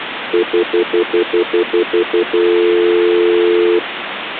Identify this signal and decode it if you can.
Telephone call progress tone (North American plan), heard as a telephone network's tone, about 350, 440 Hz, 0.1 s on and 0.1 s off, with phone line noise. Stutter dial tone.